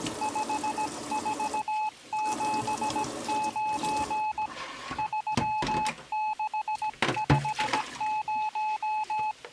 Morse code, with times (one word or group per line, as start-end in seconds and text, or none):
0.2-4.5 5479
5.0-9.3 3650